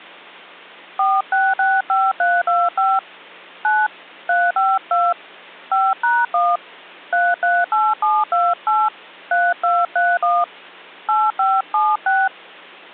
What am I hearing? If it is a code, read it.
DTMF, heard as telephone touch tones, dialled by hand, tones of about 220 ms. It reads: 4665325 9 352 5#1 338728 3231 8576